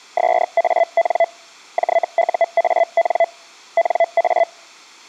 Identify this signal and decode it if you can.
Hellschreiber (Feld-Hell, 122.5 baud), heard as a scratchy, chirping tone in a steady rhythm, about 670 Hz. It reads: SAN JUAN NA